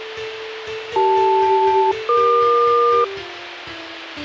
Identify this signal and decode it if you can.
Aircraft SELCAL, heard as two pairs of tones, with radio hiss and a squelch burst at the end. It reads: CL-EQ